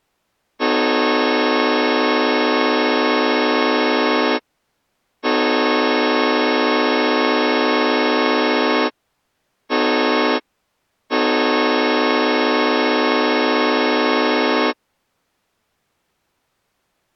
Train horn signal, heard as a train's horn. 2 long, 1 short, 1 long. On North American railways: approaching a public crossing.